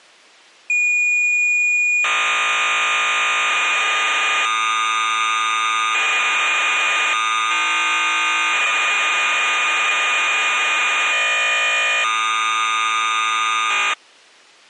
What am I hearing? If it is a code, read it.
Cassette data (Kansas City type), 1200 baud, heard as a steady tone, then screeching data.